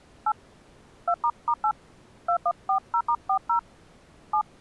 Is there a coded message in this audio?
Yes: DTMF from 0.3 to 4.4 s, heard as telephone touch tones, dialled by hand, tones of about 70 ms. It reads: 8 2**8 2140*40 7